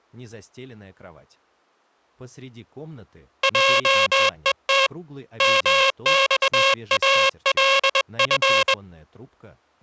Morse code (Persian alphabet), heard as a buzzer, hand-sent with a bug key, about 21 wpm. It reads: جهت مخالف